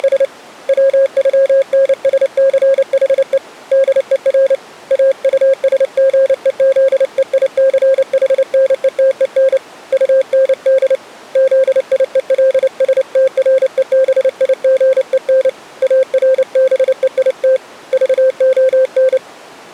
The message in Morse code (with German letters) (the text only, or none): … WÜNSCHE DER AUSGEZEICHNETEN UND ZIELSTREBIGEN ARBEIT VON